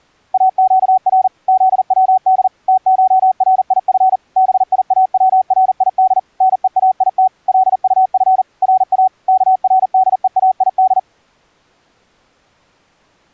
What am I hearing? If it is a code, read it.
Morse code (Persian alphabet), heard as a keyed tone, machine-sent, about 40 wpm, 750 Hz. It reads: اگر زود تشریف بیاورید نهایت لطف را کردهاید